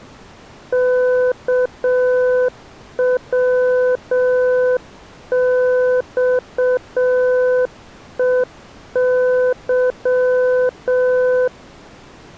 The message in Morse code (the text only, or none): KWXEY